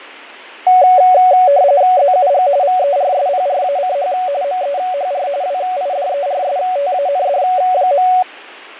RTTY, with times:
2.0-2.5 ZUG
2.6-4.1 VERSPRACH
4.4-5.3 MEHR
5.4-8.1 WIDERSTAND.

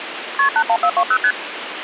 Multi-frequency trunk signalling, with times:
0.4-0.5 KP
0.6-1.2 81420
1.2-1.3 ST

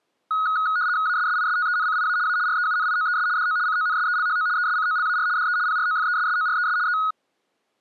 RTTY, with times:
1.1-2.2 ASSISTENCIA
2.3-2.4 A
2.5-3.3 REUNIOES
3.4-3.6 DO
3.7-4.5 CONSELHO
4.6-5.3 ESCOLAR
5.4-5.6 DE
5.7-6.8 PROFESSORES
6.9-7.0 E

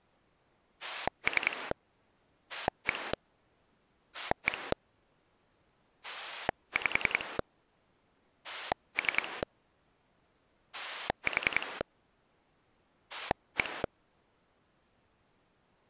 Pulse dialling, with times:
0.8-1.7 3
2.5-3.1 1
4.1-4.7 1
6.0-7.4 5
8.4-9.4 3
10.7-11.8 4
13.1-13.8 1

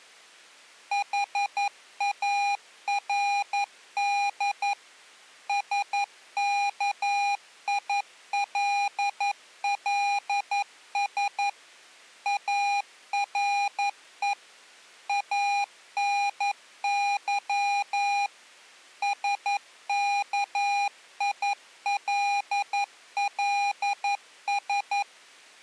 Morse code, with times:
0.9-4.7 HARD
5.5-11.5 SKILLS
12.3-14.3 ARE
15.1-18.3 ANY
19.0-25.0 SKILLS

